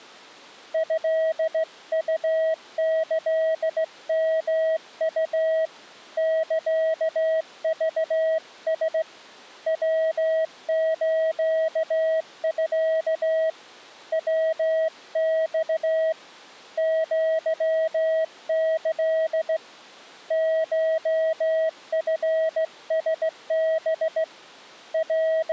Morse code (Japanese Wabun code), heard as a keyed tone, hand-sent with a straight key, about 16 wpm, 640 Hz. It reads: トウキヨウ サクラ ヤスミ ヤマ アキ コチラハ …